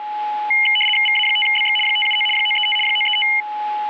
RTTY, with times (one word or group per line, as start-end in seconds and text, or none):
1.1-1.8 VA5BX
1.9-2.3 579
2.4-2.8 935
2.9-3.3 935